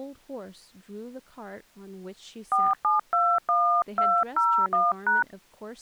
DTMF, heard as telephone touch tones, dialled by hand, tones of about 230 ms, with speech in English. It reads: 4721201#